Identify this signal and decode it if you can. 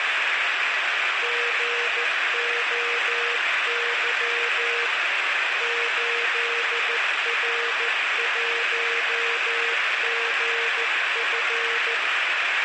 Morse code, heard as a keyed tone, hand-sent with a paddle, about 14 wpm, 470 Hz, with heavy radio static. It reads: GOY 8R1GF